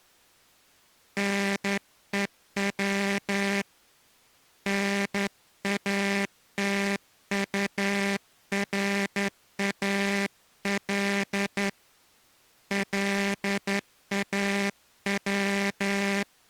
Morse code, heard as a buzzer, hand-sent with a straight key, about 11 wpm. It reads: NEW NATURAL LAW